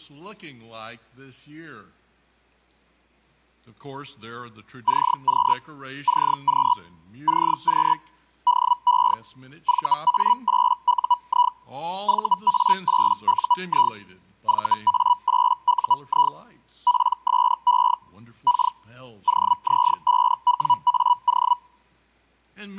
Hellschreiber (Feld-Hell, 122.5 baud), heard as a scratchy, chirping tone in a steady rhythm, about 980 Hz. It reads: CQ CQ CQ DE VA8UI VA8UI VA8UI PSE K OZ5WAO